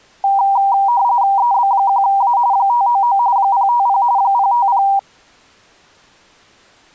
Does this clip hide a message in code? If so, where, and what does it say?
Yes: RTTY (45.45 baud, 170 Hz shift) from 0.2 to 5.0 s, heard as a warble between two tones, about 870 Hz centre. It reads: EB1A 599 050 050